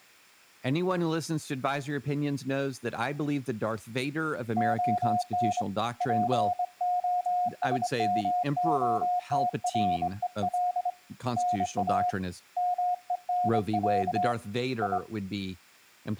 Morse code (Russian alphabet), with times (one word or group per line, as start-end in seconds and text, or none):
4.6-5.6 ОН
6.0-10.9 ПОСМОТРЕЛ
11.4-12.1 НА
12.6-14.3 МЕНЯ
14.8-15.0 И